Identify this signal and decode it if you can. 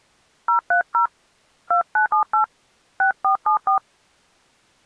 DTMF, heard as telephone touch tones, dialled by hand, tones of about 110 ms. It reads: 030 2978 6474